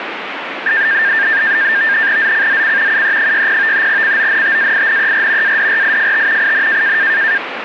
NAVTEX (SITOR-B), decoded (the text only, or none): ZCZC UE60 CONTAINER ADRIFT IN